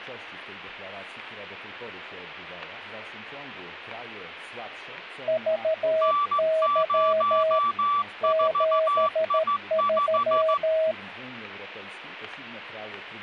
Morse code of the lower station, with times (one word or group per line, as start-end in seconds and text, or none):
5.3-7.6 VY
8.2-10.9 73